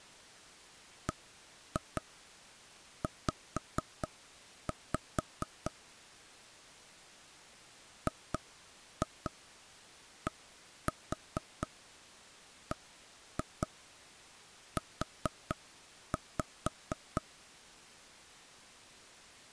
Tap code, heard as knocks on wood, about 4 knocks a second. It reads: BZ GDBU